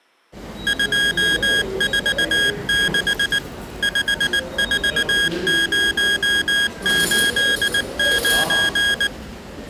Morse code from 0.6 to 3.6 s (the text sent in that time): 246